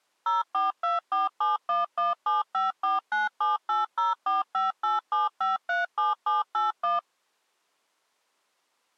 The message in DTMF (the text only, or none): 042471175497804587537781